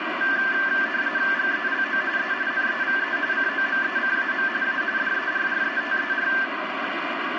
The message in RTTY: GELO E NEVE COMECAM A DERRETER

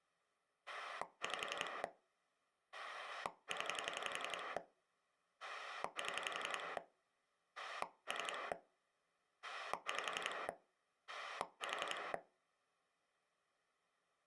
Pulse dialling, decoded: 5 0 7 3 5 4

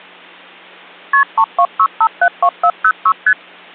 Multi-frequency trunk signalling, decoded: KP 326572406 ST

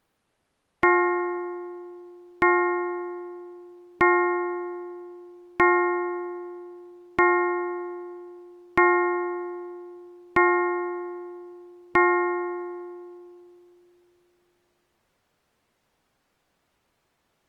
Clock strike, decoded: 8

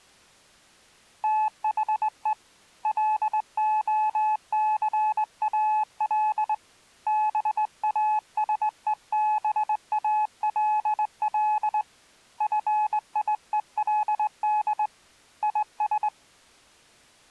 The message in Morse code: THE LOCAL BASEBALL FIELD IS

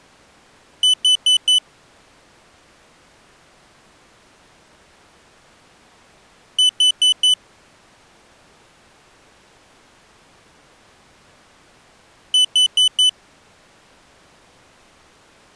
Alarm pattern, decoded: temporal four

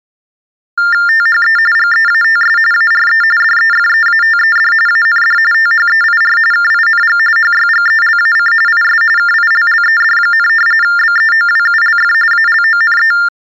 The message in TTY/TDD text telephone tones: THE GEATS ARE DEFEATED AND THEIR KING HYGELAC IS KILLED, BEOWULF ALONE

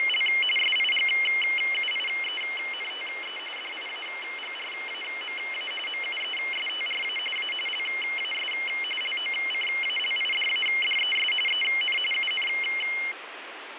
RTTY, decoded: … SIGUIENTE DIAGRAMA MUESTRA A LAS LOCALIDADES EN UN

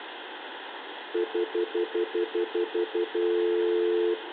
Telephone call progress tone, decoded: stutter dial tone

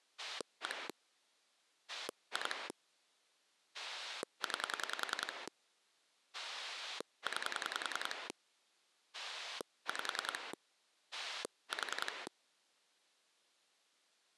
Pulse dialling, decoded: 1 2 9 9 5 4

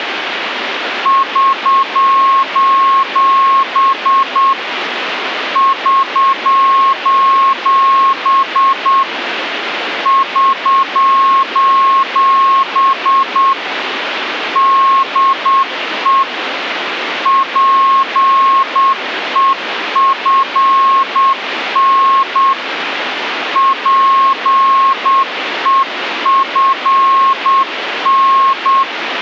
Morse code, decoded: <SOS> <SOS> <SOS> DE PEFN PEFN

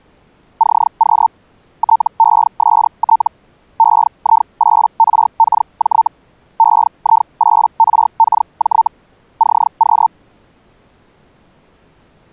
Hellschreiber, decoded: CQ TEST EI8RKJ EI8RKJ CQ

